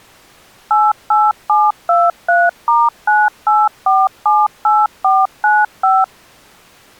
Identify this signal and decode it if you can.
DTMF, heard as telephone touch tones, dialled by machine, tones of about 210 ms. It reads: 88723*98478495